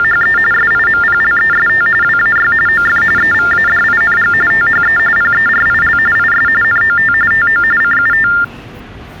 TTY/TDD text telephone tones (45.45 baud Baudot), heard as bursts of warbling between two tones, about 400 Hz shift, 1600 Hz centre, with the noise of a subway station. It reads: … SIMPLEST WAY OF EVADING THE PERIL IS NOT TO CUT